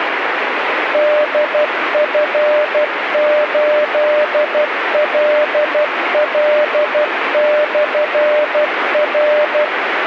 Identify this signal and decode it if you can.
Morse code, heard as a keyed tone, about 12 wpm, 600 Hz, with radio static. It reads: DF8LL/R